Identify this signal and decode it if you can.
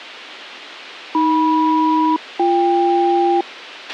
Aircraft SELCAL, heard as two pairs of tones, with a squelch burst at the end. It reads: AM-BK